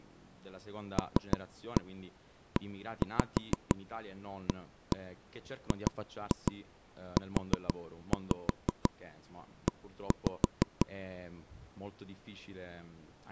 Tap code, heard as knocks on wood, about 6 knocks a second, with speech in Italian. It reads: LEAGUE